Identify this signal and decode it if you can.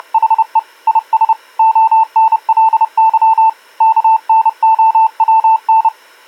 Morse code, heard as a keyed tone, hand-sent with a paddle, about 30 wpm, 890 Hz. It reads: … IS ONLY KNOWN